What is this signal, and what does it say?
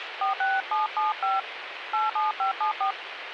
DTMF, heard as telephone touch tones, dialled by hand, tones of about 160 ms, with phone line noise. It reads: 46775 87574